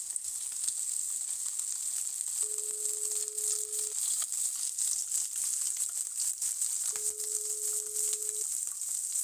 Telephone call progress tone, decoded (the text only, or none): ringback tone